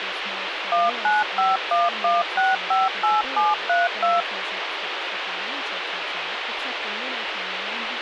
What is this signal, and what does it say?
DTMF, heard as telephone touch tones, dialled by machine, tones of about 180 ms, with phone line noise and speech in English. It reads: 19511658732